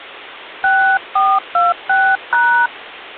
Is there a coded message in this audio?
Yes: DTMF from 0.6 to 2.7 s, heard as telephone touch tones, dialled by hand, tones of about 250 ms. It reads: 6426#